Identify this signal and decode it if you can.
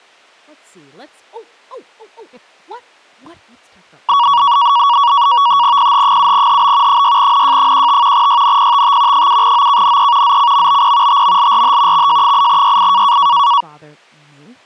NAVTEX (SITOR-B), 100 baud, 170 Hz shift, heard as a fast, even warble, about 1040 Hz centre, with speech in English. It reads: PH7HB 6NJ15 YNPTT 7OKNE ZCMBP TMLRH XJ8YI